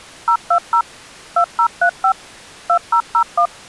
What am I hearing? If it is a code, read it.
DTMF, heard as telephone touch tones, dialled by machine, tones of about 80 ms. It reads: 020 2035 2001